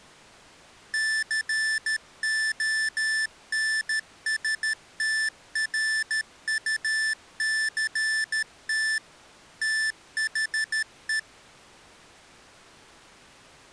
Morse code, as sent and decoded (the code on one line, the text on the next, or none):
-.-. --- -. ... - .-. ..- -.-. - / - .... .
CONSTRUCT THE